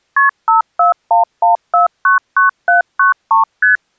Multi-frequency trunk signalling (R1, as on North American trunks), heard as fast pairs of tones, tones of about 130 ms. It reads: KP 5411499793 ST